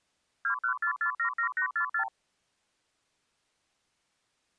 Multi-frequency trunk signalling (R2, with the far end's replies), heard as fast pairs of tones, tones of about 90 ms. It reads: 214477844